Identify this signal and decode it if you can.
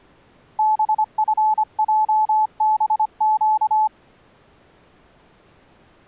Morse code, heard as a keyed tone, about 25 wpm, 860 Hz. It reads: BFJBQ